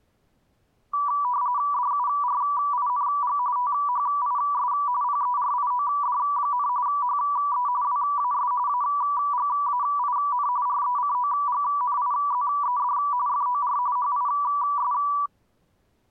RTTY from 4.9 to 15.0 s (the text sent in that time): PERIOD, HE WAS AGAIN RECOGNIZED FOR HIS